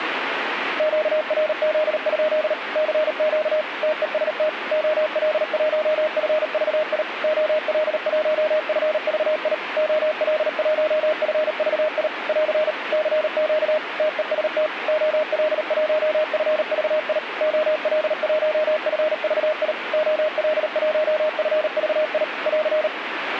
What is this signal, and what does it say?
Morse code, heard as a keyed tone, machine-sent, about 38 wpm, 620 Hz, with radio static. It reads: QRZ? CQ TEST OL1FVI OL1FVI OL1FVI <AR> CQ TEST OL1FVI OL1FVI OL1FVI <AR>